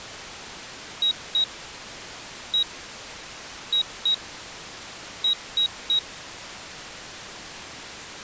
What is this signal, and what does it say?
Beep code, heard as a piezo beeper, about 3850 Hz. 2-1-2-3. In Phoenix BIOS tables: ROM copyright notice check failure.